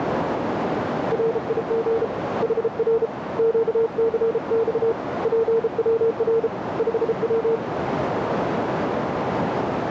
Morse code, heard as a keyed tone, hand-sent with a bug key, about 33 wpm, 450 Hz, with heavy radio static and a narrow filter. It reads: RIG HR QCX PWR 5W